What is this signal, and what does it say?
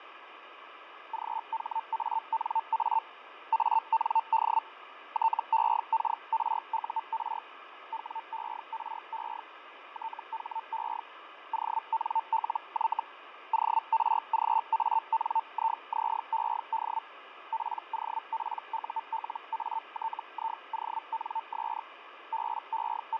Hellschreiber (Feld-Hell, 122.5 baud), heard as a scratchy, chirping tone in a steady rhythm, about 900 Hz, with radio static and fading. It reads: GHANA AND TEKRUR WERE THE ONLY ORGANIZED POPULATIONS …